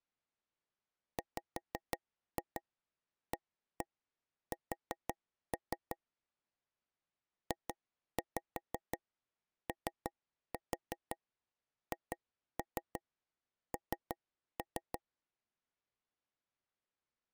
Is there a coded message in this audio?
Yes: tap code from 1.2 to 15.0 s, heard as taps on a table, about 5 knocks a second. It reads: WAS JOHN